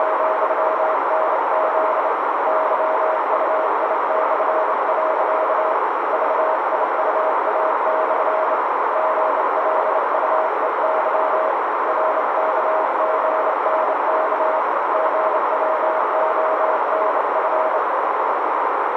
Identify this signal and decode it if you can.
Morse code, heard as a keyed tone, hand-sent with a bug key, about 28 wpm, 630 Hz, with heavy radio static and a narrow filter. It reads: … YUI/. VIUA/ GLUEY RKGNK GWONF